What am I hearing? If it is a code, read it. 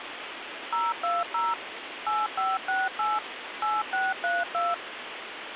DTMF, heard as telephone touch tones, dialled by machine, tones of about 200 ms, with phone line noise. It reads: 020 8568 8632